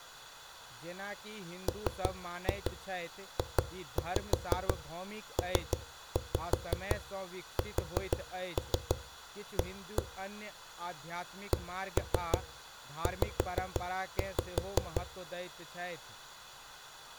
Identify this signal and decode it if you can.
Tap code, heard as knocks on a wall, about 6 knocks a second, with room echo and speech in Maithili. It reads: MJPSA CZ